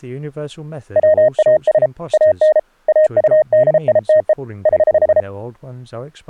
Morse code, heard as a keyed tone, hand-sent with a paddle, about 33 wpm, 620 Hz, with speech in English. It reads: WAS AN AUDITE <HH>